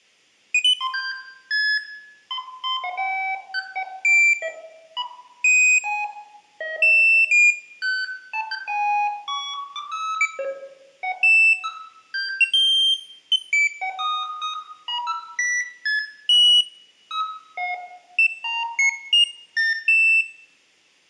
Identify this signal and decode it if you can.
Electronic bleeps of random pitch and length, with room echo. There is no code.